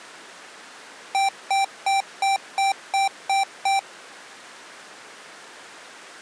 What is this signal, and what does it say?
Beep code, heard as beeps from a small speaker, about 780 Hz. 8 short. In AMI BIOS tables: display memory failure; in Dell tables: LCD failure.